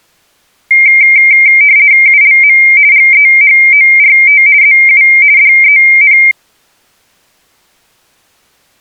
RTTY (50 baud, 170 Hz shift), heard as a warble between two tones, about 2200 Hz centre. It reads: ULM GEHORT ZU DEN